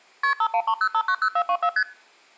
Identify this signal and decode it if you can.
Multi-frequency trunk signalling (R1, as on North American trunks), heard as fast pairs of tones, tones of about 70 ms. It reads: KP 5130590424 ST